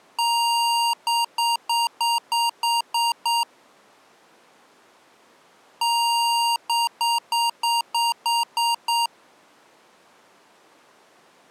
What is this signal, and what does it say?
Beep code, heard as beeps from a small speaker, played twice, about 940 Hz. 1 long, 8 short. In AMI BIOS tables: display or retrace test failure.